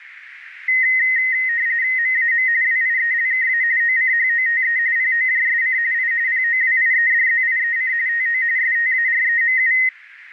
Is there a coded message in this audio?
Yes: RTTY (45.45 baud, 170 Hz shift) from 0.7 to 9.9 s, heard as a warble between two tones, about 1950 Hz centre, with radio static. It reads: MAM WIELKA OCHOTE POJSC I POWIEDZIEC TO STAREMU